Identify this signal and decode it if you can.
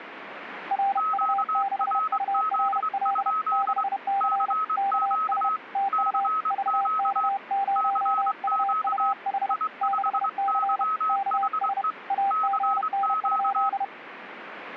Morse code, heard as two keyed tones, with radio static. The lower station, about 31 wpm, 790 Hz: RU6URL 6C KS TU VK0UUH 6C KS AGN?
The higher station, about 23 wpm, 1280 Hz: QRZ? CQ CQ CQ I5YHE CQ